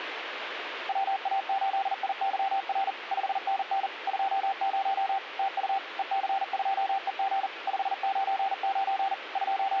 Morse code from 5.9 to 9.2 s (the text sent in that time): EC2EG 599